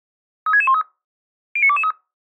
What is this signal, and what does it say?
Five-tone selective call (ZVEI), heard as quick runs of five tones, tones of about 70 ms. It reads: 36613 09223